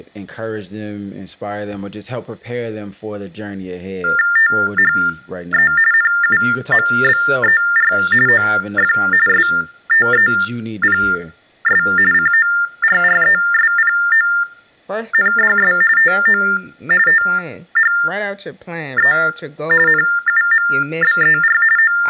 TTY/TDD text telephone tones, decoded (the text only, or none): THE NUMBER OF STEPS CORRESPONDS TO THE NUMBER …